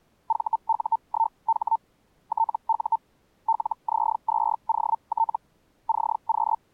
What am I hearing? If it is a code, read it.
Hellschreiber (Feld-Hell, 122.5 baud), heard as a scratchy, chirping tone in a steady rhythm, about 900 Hz. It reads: VU1H TU LZ2OT CQ